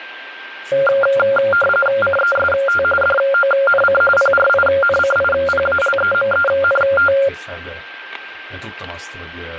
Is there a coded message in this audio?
Yes: RTTY (45.45 baud, 850 Hz shift) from 0.7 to 7.3 s, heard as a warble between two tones, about 970 Hz centre, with radio static, static crashes, a steady whistle near 1580 Hz and speech in Hungarian. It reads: CEST DONC PRINCIPALEMENT